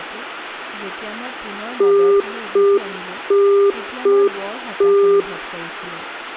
Telephone call progress tone (UK plan), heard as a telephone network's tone, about 400 Hz, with hum, room echo and speech in Assamese. Congestion tone.